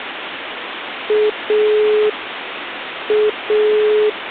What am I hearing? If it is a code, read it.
Telephone call progress tone (pulsed, as in Italy), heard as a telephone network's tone, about 420 Hz, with phone line noise. Dial tone.